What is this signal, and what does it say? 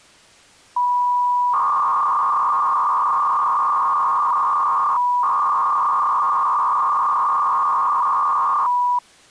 300-baud modem data (V.21 tones), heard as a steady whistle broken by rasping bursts, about 300 baud, 200 Hz shift.